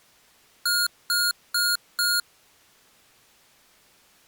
Beep code, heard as beeps from a small speaker, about 1420 Hz. 4 short. In AMI BIOS tables: system timer failure; in Dell tables: memory read or write failure.